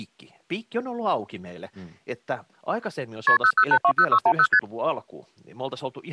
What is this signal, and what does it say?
Multi-frequency trunk signalling (R1, as on North American trunks), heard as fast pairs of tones, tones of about 70 ms, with speech in Finnish. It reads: KP 00820610 ST